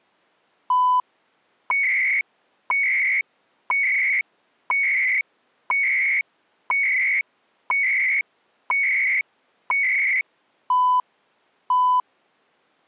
Radio time signal (CHU, Canada), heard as beeps and data bursts, one a second.